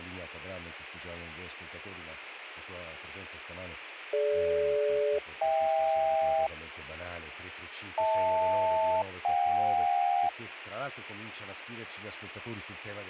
Aircraft SELCAL, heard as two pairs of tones, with radio hiss and speech in Italian. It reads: DG-HK HL-JK